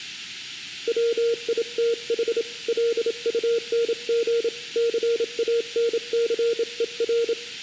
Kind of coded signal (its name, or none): Morse code